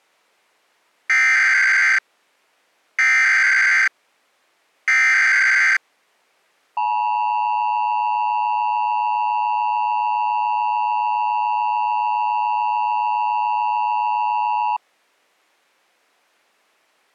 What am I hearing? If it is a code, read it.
Emergency Alert System (SAME) tones (header bursts, then the 853 and 960 Hz attention tone), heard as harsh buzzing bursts, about 520.83 baud.